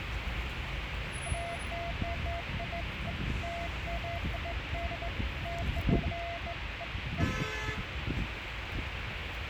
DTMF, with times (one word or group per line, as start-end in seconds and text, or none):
none